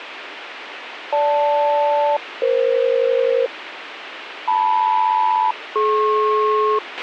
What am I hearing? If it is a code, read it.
Aircraft SELCAL, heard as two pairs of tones, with radio hiss and a squelch burst at the end. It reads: GL-EF LM-DP